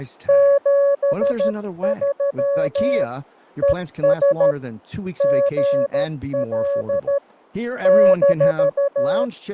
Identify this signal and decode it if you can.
Morse code, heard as a keyed tone, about 13 wpm, 560 Hz, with fading and speech in English. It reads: 73 ES GL -